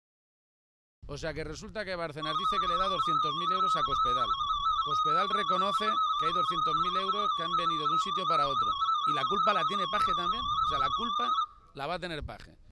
Multi-tone FSK (Olivia or MFSK type), about 250 Hz wide, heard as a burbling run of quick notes, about 31.25 baud.